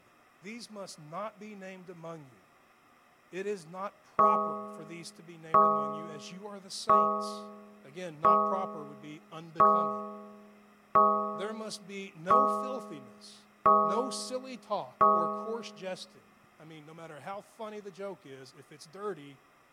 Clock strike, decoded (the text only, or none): 9